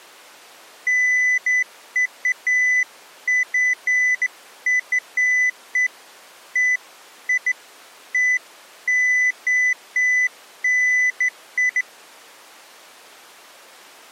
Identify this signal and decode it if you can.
Beeps of irregular length. There is no code.